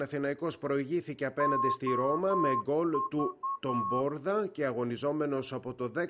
Morse code, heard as a whistle, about 10 wpm. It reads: OV